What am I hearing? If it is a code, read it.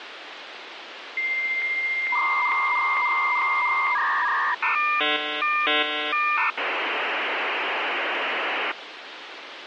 Dial-up modem handshake (V.34 or later), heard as a whistle, warbles, then hiss, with phone line noise.